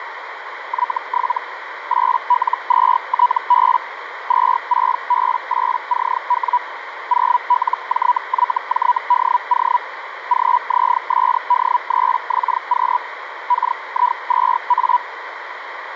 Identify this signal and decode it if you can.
Hellschreiber (Feld-Hell, 122.5 baud), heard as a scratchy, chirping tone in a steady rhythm, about 980 Hz, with radio static and a narrow filter. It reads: Y7 8L2TB 26B8CW 0LJYJDO GZSD3XQ KI2A